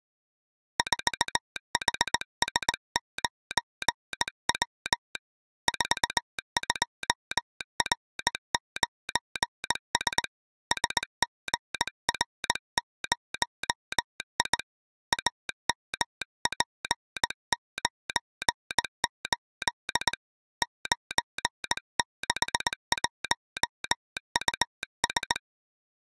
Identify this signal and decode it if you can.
Morse code, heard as a telegraph sounder, hand-sent with a straight key, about 19 wpm. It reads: 4HS9W 42R9S SGR0I AMP98 961US